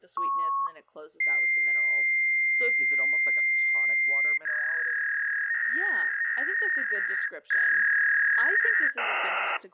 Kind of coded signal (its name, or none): fax machine handshake